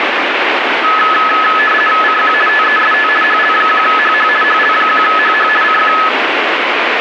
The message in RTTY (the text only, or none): CQ TEST HL1HH HL1HH CQ